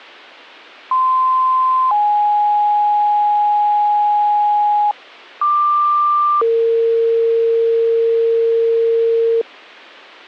Two-tone page, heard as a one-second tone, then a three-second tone, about 1040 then 830 Hz, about 1180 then 460 Hz, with a squelch burst at the end.